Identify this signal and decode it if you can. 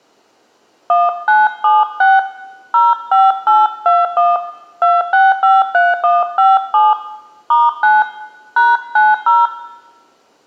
DTMF, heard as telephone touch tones, dialled by hand, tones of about 190 ms, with room echo. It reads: 1976 05821 2653157 *9 #90